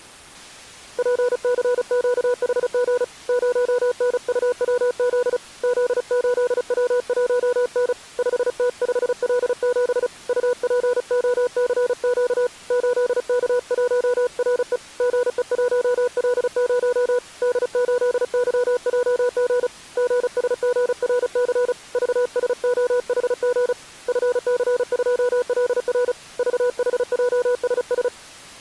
Morse code, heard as a keyed tone, hand-sent with a paddle, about 35 wpm, 490 Hz. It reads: PCQHG 0NUWZ Z8W1N 5T5L7 UPOCQ 8K1RE GE1L0 D8YJG GSGRC VSOHG FC2LR VHJSS